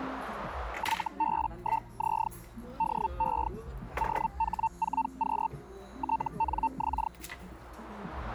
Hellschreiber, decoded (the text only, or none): YB1Z DE OH4Q TNX